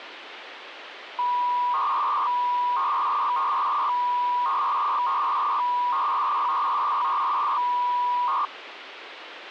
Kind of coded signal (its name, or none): 300-baud modem data